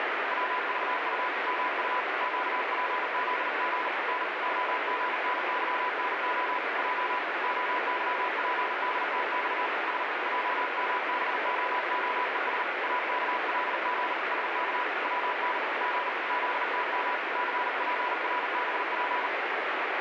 Morse code, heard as a keyed tone, hand-sent with a paddle, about 39 wpm, 990 Hz, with heavy radio static. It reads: WVU MU QPZG N OGNYNO J OYPDTX S JMBOOES AKLG SK WN G ZTM CPRBP